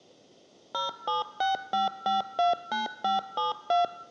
DTMF, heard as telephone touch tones, dialled by machine, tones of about 150 ms, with room echo. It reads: 0765529572